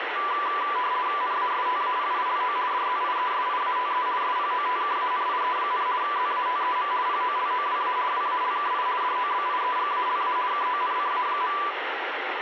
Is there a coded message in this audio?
Yes: RTTY (50 baud, 170 Hz shift) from 0.2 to 11.7 s, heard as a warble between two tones, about 1080 Hz centre, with radio static. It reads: NASTAPILO DZIESIATE SPOTKANIE, ZATEM POLOWA WALKI DOBIEGALA KONCA.